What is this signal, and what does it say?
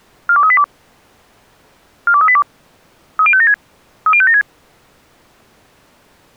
Five-tone selective call (ZVEI), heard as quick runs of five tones, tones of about 70 ms. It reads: 42382 42382 30576 30576